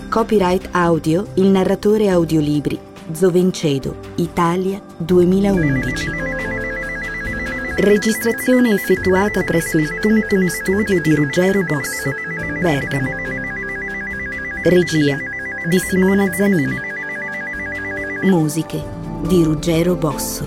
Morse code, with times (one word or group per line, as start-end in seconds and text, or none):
none